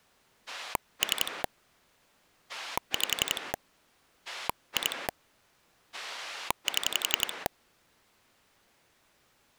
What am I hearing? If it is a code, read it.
Pulse dialling, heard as a rotary dial, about 11 pulses a second. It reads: 3 5 2 7